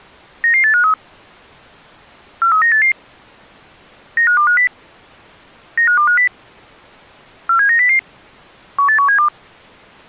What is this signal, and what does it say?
Five-tone selective call (CCIR), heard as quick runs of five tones, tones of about 100 ms. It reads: 99853 43988 95250 95250 47900 18172